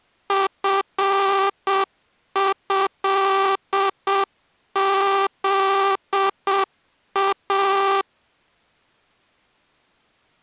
Morse code (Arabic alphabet), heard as a buzzer, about 7 wpm. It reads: فهذا